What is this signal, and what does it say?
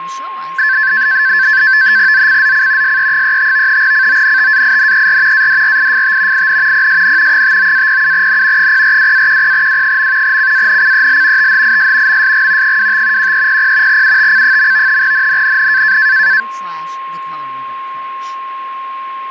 NAVTEX (SITOR-B), 100 baud, 170 Hz shift, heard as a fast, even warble, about 1650 Hz centre, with a steady whistle near 1070 Hz and speech in English. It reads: ZCZC SE35 CONTAINER ADRIFT IN PSN 59-07N 042-10W. CANCEL THIS MSG 25 1300 UTC. NNNN